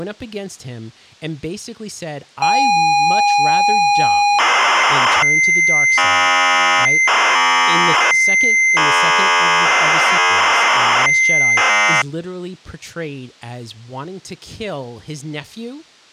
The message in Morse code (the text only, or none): none